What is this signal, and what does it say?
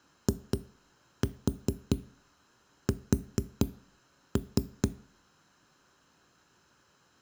Tap code, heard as knocks on a wall, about 4 knocks a second, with room echo. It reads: IS